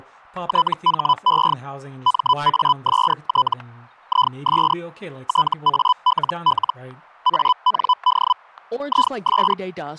Hellschreiber (Feld-Hell, 122.5 baud), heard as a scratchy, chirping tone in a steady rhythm, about 1000 Hz, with static crashes and speech in English. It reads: THE MAST IS TALL AND IS